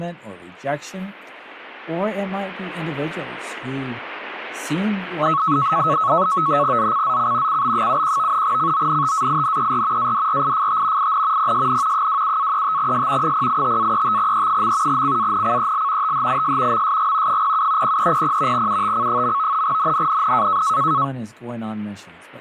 NAVTEX (SITOR-B), 100 baud, 170 Hz shift, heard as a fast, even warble, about 1200 Hz centre, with speech in English. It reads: ZCZC CB71 CONTAINER ADRIFT IN PSN 27-35S 085-35E. CANCEL THIS MSG 07 0300 UTC. NNNN